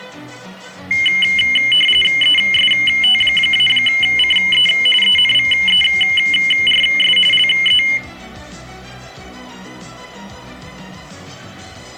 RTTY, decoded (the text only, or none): EST-CE ENVERS LE